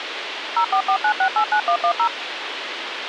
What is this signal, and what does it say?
DTMF, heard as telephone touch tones, dialled by machine, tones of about 80 ms, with radio hiss. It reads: 0449689110